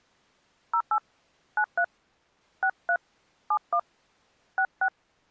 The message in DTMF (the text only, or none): 08 93 63 71 66